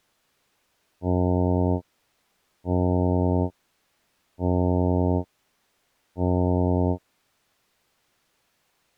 Ship horn signal, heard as a ship's horn, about 90 Hz. 4 short. At sea: a pilot vessel's identity signal in fog.